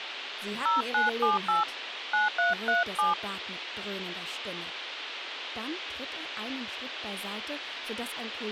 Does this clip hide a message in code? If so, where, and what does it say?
Yes: DTMF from 0.7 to 3.1 s, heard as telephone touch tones, dialled by hand, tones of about 150 ms, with radio hiss. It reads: 0978 9337